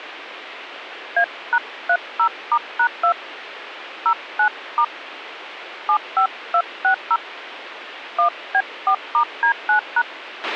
DTMF, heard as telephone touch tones, dialled by hand, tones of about 80 ms, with radio hiss and a squelch burst at the end. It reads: A#30*#2 09* 75260 1B4*D9#